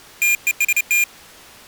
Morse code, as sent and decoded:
- . ... -
TEST

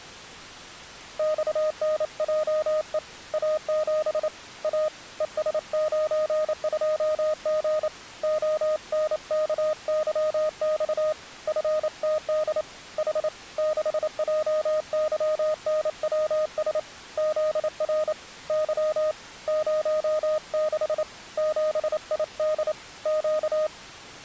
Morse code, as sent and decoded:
-..- -. .--- . / .- --... / .- / . ... ----. ..--- --. / --- -. -.- -.-- -..- / ..-. - -.. / .... / -.... .--- -.-- -. .-- ... / --.. .-. / -.-- / ----- -.... / --... .. -.. / --.-
XNJE A7 A ES92G ONKYX FTD H 6JYNWS ZR Y 06 7ID Q

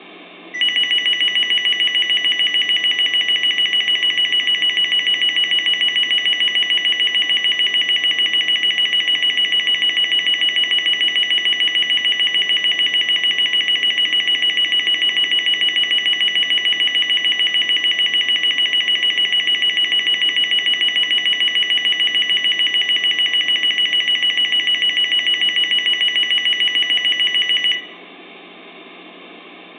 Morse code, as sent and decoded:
none

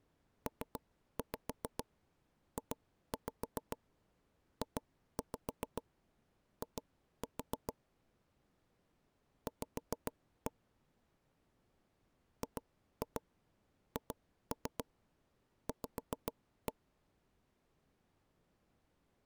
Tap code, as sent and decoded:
3-5 2-5 2-5 2-4 / 5-1 / 2-2 2-3 5-1
PJJI V GHV

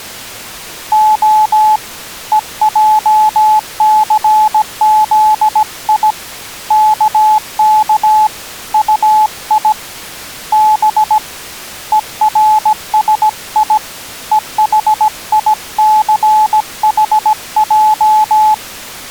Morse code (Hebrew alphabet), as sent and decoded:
--- / . .--- -.-. --.. .. / -.- -.- / ..- .. / -... / . .-. ... .. / . .... .. -.-. .... .---
ה ועסזי כך טי ב ורשי וחיסחע

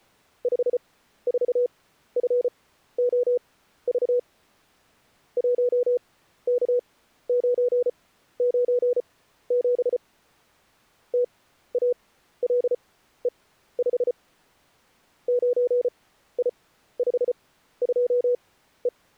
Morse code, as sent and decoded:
..... ....- ..-. --- ...- / .---- -.- ----. ----. --... / - .- .-.. . ..... / ----. .. ..... ..--- .
54FOV 1K997 TALE5 9I52E

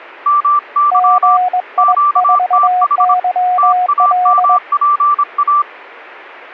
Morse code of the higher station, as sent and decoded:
-- -.-- / --.- - .... / - .- -- .--. .-
MY QTH TAMPA

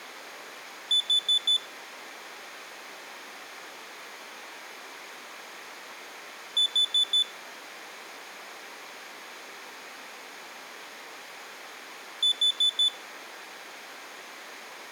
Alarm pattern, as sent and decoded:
4 beeps and a pause
temporal four

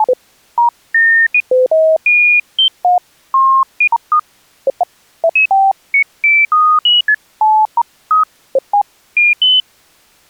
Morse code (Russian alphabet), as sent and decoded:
none

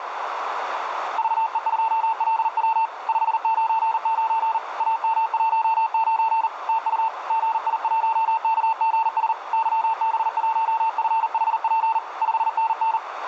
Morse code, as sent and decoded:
...- . ..--- .-.. .-- / ..... ----. ----. / .- -- .---- ----. / - ..- / --. .. .---- -.- --. ... / -.-- -... .---- ..-. .... .--. / ..... -. -.
VE2LW 599 AM19 TU GI1KGS YB1FHP 5NN

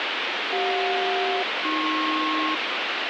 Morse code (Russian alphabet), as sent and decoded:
none

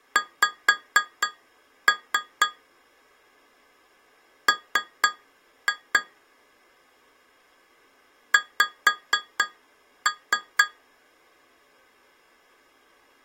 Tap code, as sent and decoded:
5-3 / 3-2 / 5-3
X M X

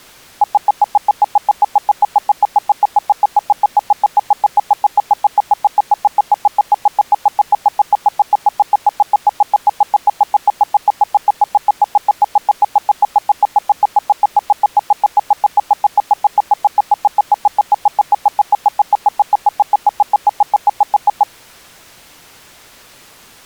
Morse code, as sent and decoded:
none

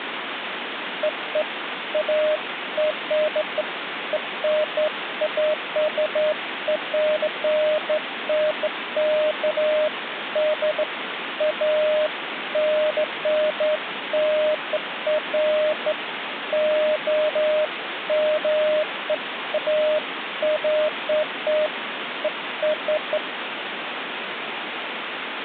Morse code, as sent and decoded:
none

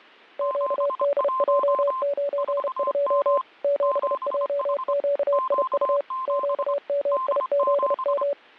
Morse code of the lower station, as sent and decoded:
--.- -.. .--- ----. ..--- / --... .--- --.- .. ..- / --.- -- .. --.. --
QDJ92 7JQIU QMIZM

